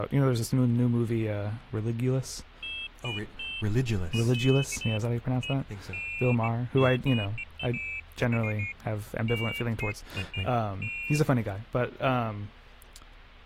Pairs of high tones at irregular times, with speech in English. There is no code.